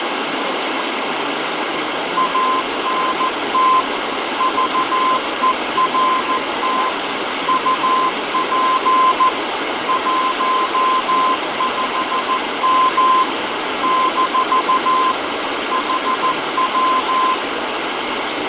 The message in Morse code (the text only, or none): ANT VERT UP 15M - HW